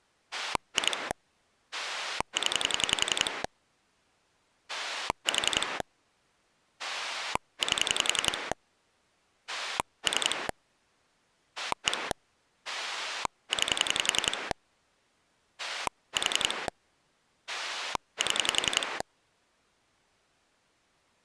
Pulse dialling, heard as a rotary dial, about 11 pulses a second. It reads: 2 0 4 8 3 1 9 4 7